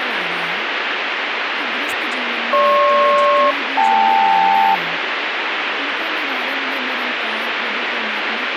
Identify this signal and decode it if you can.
Aircraft SELCAL, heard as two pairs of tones, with radio static and speech in Hindi. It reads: GP-KL